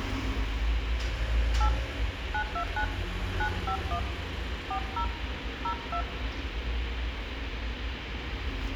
DTMF, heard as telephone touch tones, dialled by hand, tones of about 80 ms, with phone line noise, room echo and street noise. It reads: 8 929 951 40 02